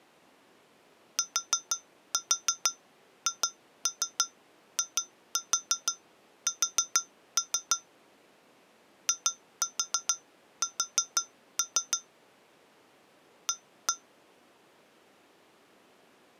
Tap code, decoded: THIS IS A

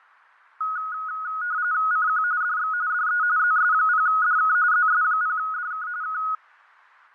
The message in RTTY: CQ DX DE ZS0DK ZS0DK K

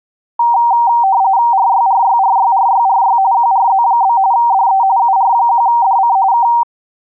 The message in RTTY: RYRYRYRYRY QRZ? DE UR1DC K

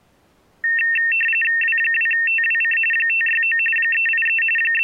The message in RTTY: W2TWC 569 383 …

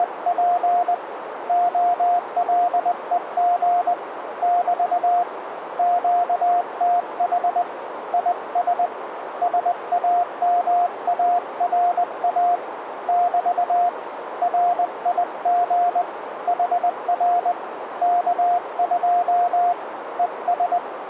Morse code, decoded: … OLEG <BT> QTH IS SAMARA <BT> RIG HR K2 ES

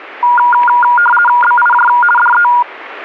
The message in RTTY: BIJ DE

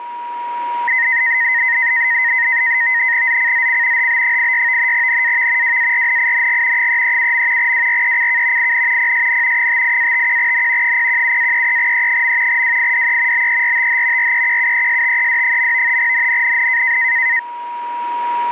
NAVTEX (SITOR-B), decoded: ZCZC HB86 NAV WARNING 337. WRECK IN PSN 58-51N 017-33E. WIDE BERTH REQUESTED. NNNN

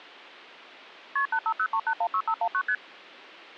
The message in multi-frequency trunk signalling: KP 8503816519 ST

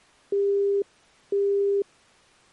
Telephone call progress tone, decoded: busy tone

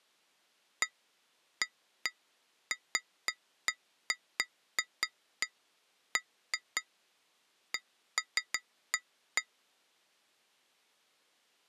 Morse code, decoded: none

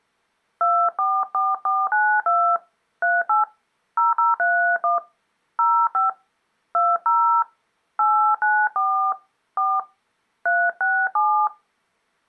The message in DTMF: 244492 38 0031 05 20 894 4 367

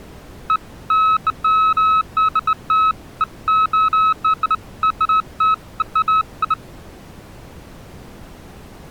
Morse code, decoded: none

